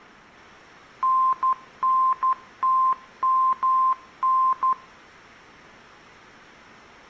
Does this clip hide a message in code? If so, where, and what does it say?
Yes: Morse code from 1.0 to 4.8 s, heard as a keyed tone, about 12 wpm, 1040 Hz, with room echo. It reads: NNTMN